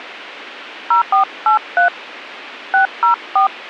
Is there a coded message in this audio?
Yes: DTMF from 0.9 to 3.5 s, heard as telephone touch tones, dialled by hand, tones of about 120 ms. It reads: 0483 604